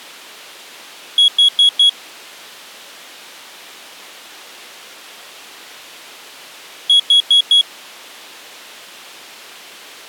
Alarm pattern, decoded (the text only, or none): temporal four